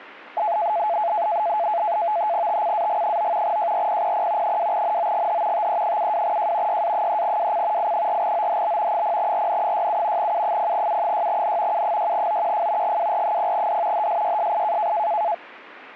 NAVTEX (SITOR-B), 100 baud, 170 Hz shift, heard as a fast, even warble, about 770 Hz centre. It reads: TCAG9 JRPPP 2NOGH TE72J YA3WC I4OHB 0RN67 U0U6N U6OQF GWR0D HSYSI